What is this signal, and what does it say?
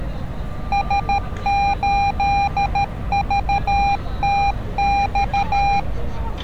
Morse code, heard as a keyed tone, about 13 wpm, 800 Hz, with street noise. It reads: S8VTX